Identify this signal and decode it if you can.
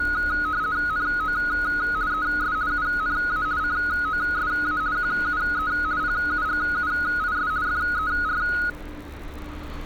RTTY (50 baud, 170 Hz shift), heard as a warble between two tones, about 1360 Hz centre, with street noise. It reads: NO ES UNA COSA QUE PUGUIS FER